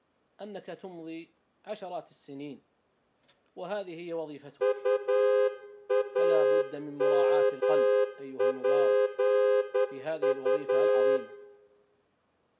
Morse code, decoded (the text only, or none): UAMPU